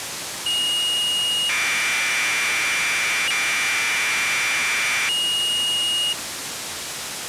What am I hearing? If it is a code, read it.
Commodore tape loading (standard loader), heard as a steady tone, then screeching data, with tape hiss.